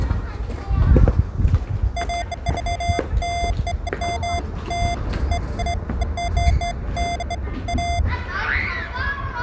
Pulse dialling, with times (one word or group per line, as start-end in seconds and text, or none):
none